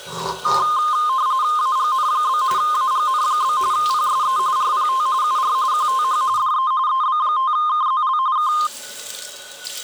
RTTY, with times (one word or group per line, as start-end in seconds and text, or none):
1.6-2.4 AGN?
2.6-3.6 AGN?
3.7-4.4 PSE
4.6-5.1 RPT
5.2-5.5 UR
5.7-6.2 QTH
6.4-6.7 DE
6.9-8.2 EB5KZL
8.4-8.5 K